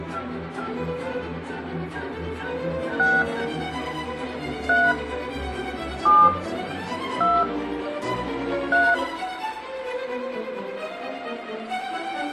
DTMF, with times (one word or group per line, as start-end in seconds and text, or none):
3.0-3.2 6
4.7-4.9 3
6.1-6.3 7
7.2-7.4 2
8.7-8.9 3